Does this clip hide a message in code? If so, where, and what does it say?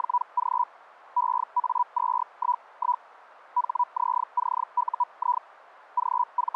Yes: Hellschreiber (Feld-Hell, 122.5 baud) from 0.0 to 6.6 s, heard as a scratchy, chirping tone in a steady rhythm, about 980 Hz. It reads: … EA211 HZCUI …